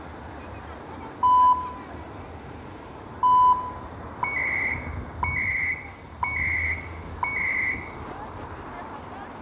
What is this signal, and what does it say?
Radio time signal (CHU, Canada), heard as beeps and data bursts, one a second, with room echo and street noise.